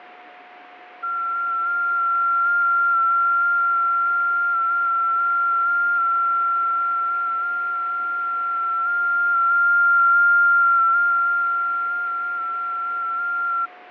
FT8 (one signal), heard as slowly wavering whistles, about 6.25 baud, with radio static, fading and a steady whistle near 720 Hz.